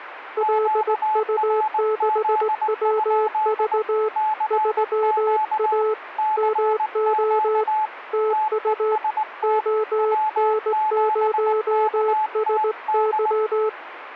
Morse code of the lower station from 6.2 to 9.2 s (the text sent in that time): MO TU